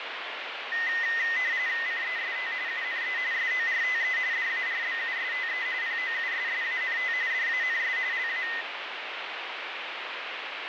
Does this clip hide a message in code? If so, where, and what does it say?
Yes: RTTY (45.45 baud, 170 Hz shift) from 0.7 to 8.6 s, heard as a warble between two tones, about 1950 Hz centre, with radio static. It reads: CEST UNE SORTE DARBUSTE POUSSANT DANS LA